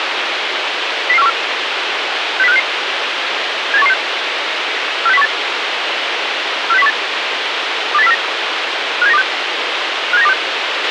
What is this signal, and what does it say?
Five-tone selective call (EEA), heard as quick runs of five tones, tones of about 40 ms, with radio hiss and a squelch burst at the end. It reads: 00414 60566 78116 46018 46018 28049 57926 57926